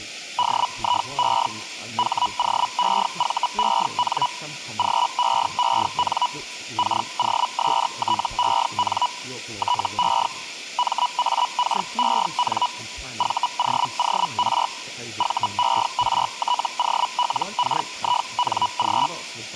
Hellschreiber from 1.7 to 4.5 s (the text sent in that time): HOEVEN